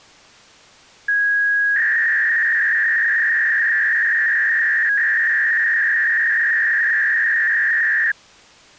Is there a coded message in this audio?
Yes: 300-baud modem data (V.21 tones) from 1.1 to 8.1 s, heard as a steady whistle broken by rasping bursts, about 300 baud, 200 Hz shift.